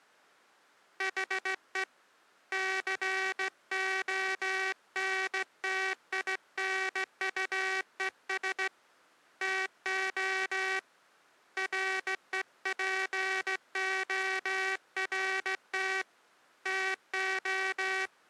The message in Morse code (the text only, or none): HE CONTINUES TO REPORT TO